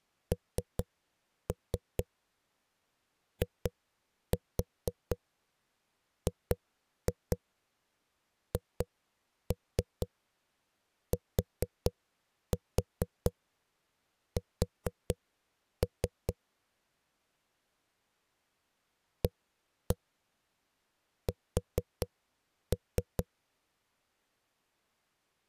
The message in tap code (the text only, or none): NIGHTS AS